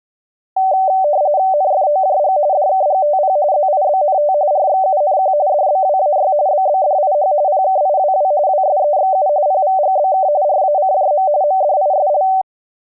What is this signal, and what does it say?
RTTY (45.45 baud, 170 Hz shift), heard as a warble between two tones, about 680 Hz centre. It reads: NFOJG DKGTP ZIBNT RXUNQ DBWAY BBDIH PKIWW WSEXU PVGBK RACJM MDISL